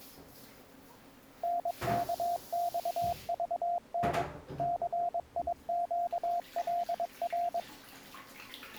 Morse code, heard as a keyed tone, machine-sent, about 22 wpm, 700 Hz, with the noise of a restroom. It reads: NKXVN CIQLR